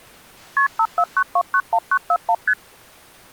Multi-frequency trunk signalling (R1, as on North American trunks), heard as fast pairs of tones, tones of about 60 ms. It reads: KP 549291941 ST